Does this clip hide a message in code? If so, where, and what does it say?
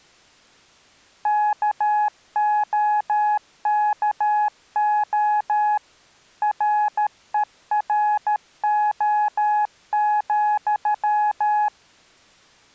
Yes: Morse code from 1.2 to 11.7 s, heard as a keyed tone, machine-sent, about 13 wpm, 840 Hz. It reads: KOKO RERO,